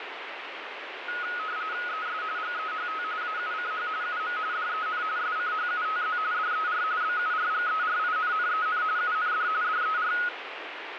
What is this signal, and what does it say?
RTTY (45.45 baud, 170 Hz shift), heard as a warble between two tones, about 1360 Hz centre, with radio static. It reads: ES GEHT AUCH UM DEN SCHUTZ DER BURGERINNEN UND DER